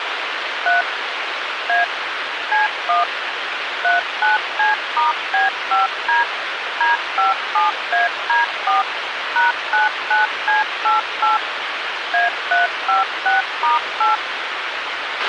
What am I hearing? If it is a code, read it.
DTMF, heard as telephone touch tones, dialled by machine, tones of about 150 ms, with radio hiss and a squelch burst at the end. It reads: 3 A C1 39C*B5D D57AD4 #99C88 A356*8